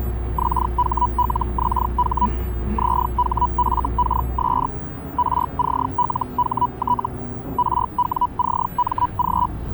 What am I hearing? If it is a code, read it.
Hellschreiber (Feld-Hell, 122.5 baud), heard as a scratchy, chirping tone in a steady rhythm, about 980 Hz, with the noise inside a bus. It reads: XHLXH ZHFKS RCLHT RWCMG